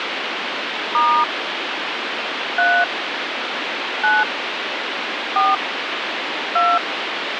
DTMF, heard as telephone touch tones, dialled by hand, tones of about 240 ms, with phone line noise. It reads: * 3 9 4 2